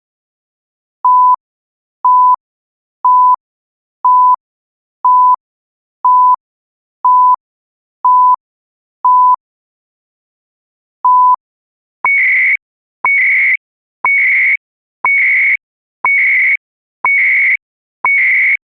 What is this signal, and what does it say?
Radio time signal (CHU, Canada), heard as beeps and data bursts, one a second.